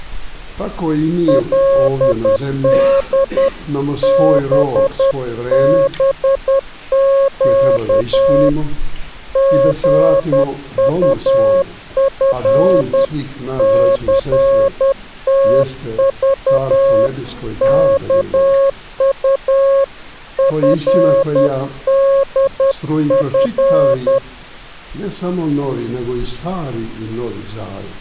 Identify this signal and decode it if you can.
Morse code (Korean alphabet), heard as a keyed tone, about 10 wpm, 550 Hz. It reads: 그때 신철이는